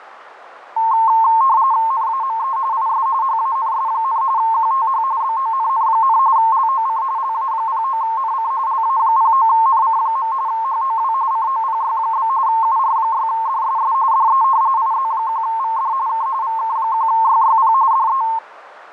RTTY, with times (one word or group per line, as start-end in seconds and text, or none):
1.9-2.6 NAME
2.7-3.1 IS
3.2-4.2 HANS,
4.4-5.0 QTH
5.2-6.2 BONN,
6.4-7.0 LOC
7.2-8.5 LA09NC
8.7-10.3 LA09NC.
10.5-11.1 HOW
11.3-12.3 COPY?
12.5-13.9 UR6DSS
14.1-14.4 DE
14.8-15.9 IZ1VD
16.1-16.3 K
16.4-17.7 VK1YYP
17.9-18.2 DE